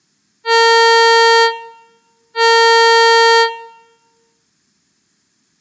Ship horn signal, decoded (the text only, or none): 2 short